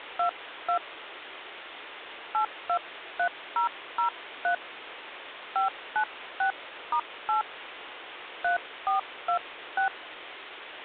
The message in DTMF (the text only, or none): 22 823003 596*8 3426